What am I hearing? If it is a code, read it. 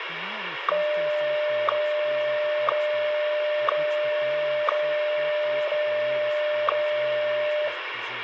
Radio time signal (WWVH, Hawaii), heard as ticks, one a second, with radio static and speech in English.